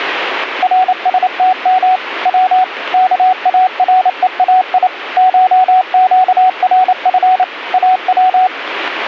Morse code (Persian alphabet), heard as a keyed tone, machine-sent, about 28 wpm, 750 Hz, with radio static. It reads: رستم و کارهای شگرف او